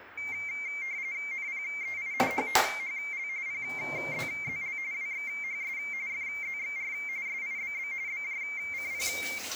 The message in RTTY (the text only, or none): NPEI HTHL PZZL WXHS FZXR SIBB BJCP